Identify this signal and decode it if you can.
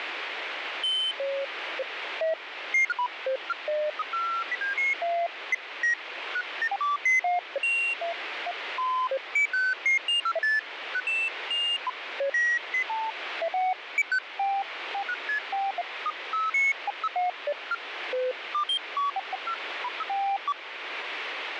Electronic bleeps of random pitch and length, with radio static. There is no code.